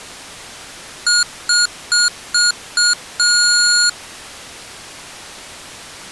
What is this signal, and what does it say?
Beep code, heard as beeps from a small speaker, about 1430 Hz. 5 short, 1 long.